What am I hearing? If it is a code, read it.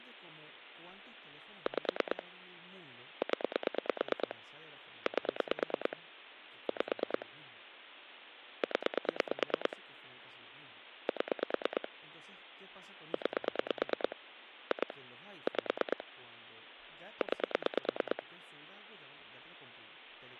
Pulse dialling, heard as clicks on a phone line, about 9 pulses a second, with speech in Spanish. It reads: 5 0 8 5 0 7 9 2 5 9